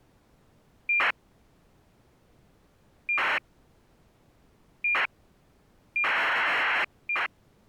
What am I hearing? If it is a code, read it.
ACARS aircraft data, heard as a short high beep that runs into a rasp, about 2400 baud.